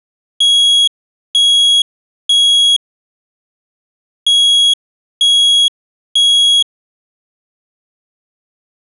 Alarm pattern, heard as an alarm's beeps, played twice, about 3300 Hz. Temporal three. Smoke or fire, evacuate.